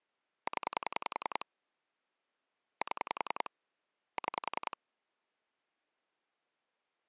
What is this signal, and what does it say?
Pulse dialling, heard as clicks on a phone line, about 10 pulses a second. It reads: 0 7 6